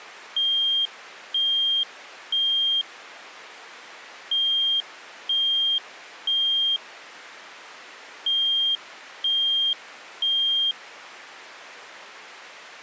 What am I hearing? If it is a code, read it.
Alarm pattern, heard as an alarm's beeps, played three times, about 3200 Hz. Temporal three. Smoke or fire, evacuate.